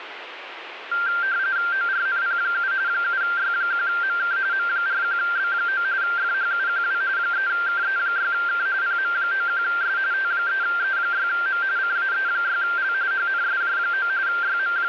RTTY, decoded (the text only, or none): ORNP7 7Y1MK M41B9 FHUQW 3KE6K PM91S T3E6M CAE6L HNSJ9 …